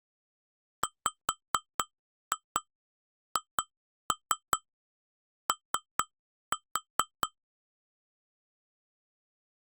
Tap code, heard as taps on glass, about 4 knocks a second. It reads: WHO